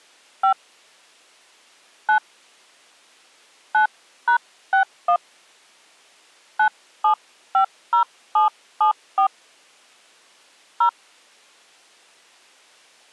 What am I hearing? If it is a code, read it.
DTMF, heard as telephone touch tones, dialled by hand, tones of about 100 ms. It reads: 5 9 9#61 9750774 0